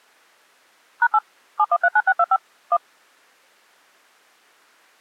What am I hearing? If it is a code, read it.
DTMF, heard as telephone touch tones, dialled by machine, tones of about 50 ms. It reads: #8 7139625 1